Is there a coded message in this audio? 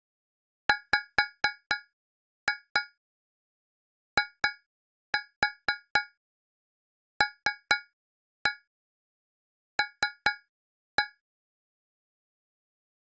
Yes: tap code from 0.7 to 11.2 s, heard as taps on a metal pipe, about 4 knocks a second. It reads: WILL